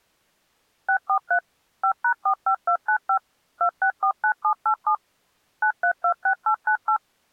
DTMF, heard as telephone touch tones, dialled by machine, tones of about 80 ms. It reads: 643 5#45295 2649787 9326898